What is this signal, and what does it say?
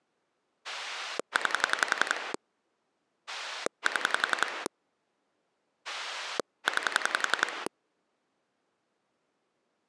Pulse dialling, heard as a rotary dial, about 11 pulses a second. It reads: 9 7 9